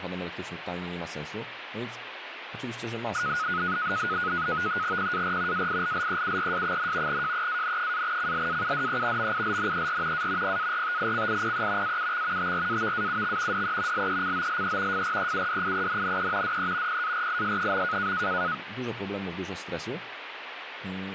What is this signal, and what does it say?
NAVTEX (SITOR-B), 100 baud, 170 Hz shift, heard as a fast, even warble, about 1360 Hz centre, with radio static and speech in Polish. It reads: PAR AILLEURS, JEAN-CLAUDE MILNER A PARTICIPE AUX TRAVAUX DE LECOLE FREUDIENNE DE PARIS.